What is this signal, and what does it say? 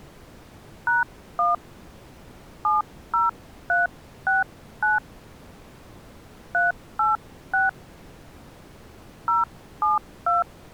DTMF, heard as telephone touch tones, dialled by hand, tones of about 160 ms. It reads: #1 70369 386 072